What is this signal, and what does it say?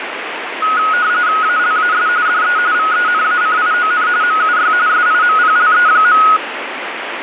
RTTY (45.45 baud, 170 Hz shift), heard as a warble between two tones, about 1360 Hz centre, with radio static. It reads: ALAS DE VENACION MUY SIMPLE.